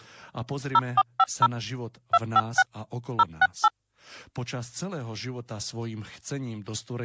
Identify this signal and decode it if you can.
DTMF, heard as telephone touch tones, dialled by machine, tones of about 40 ms, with speech in Slovak. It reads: 0450 256 068